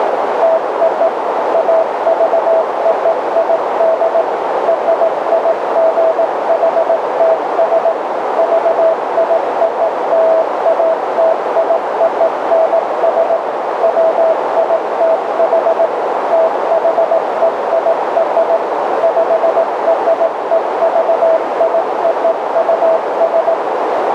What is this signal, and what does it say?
Morse code (American railroad code), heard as a keyed tone, machine-sent, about 650 Hz, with heavy radio static and a narrow filter. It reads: TO AVOID RIGHTS VIOLATIONS WITH THEIR PREVIOUS